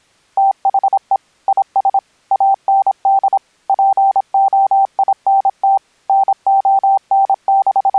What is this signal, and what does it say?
Morse code, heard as a keyed tone, machine-sent, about 26 wpm, 780 Hz. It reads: THE IS AND POINT …